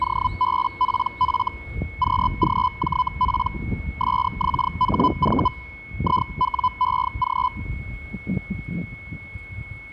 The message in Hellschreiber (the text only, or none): OBPF QGJP SXHV IWEG